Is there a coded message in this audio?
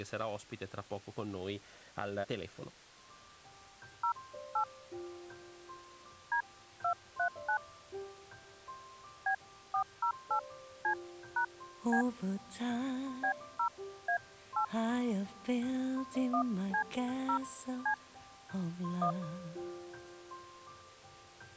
Yes: DTMF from 4.0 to 19.1 s, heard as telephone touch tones, dialled by hand, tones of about 90 ms. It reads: 08 D239 B408C#B B0A8 1C0C 1